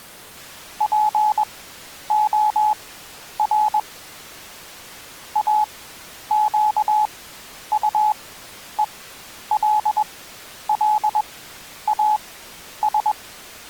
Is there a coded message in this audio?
Yes: Morse code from 0.7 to 13.2 s, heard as a keyed tone, machine-sent, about 21 wpm, spaced as for 10 wpm, 850 Hz. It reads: POR AQUELLAS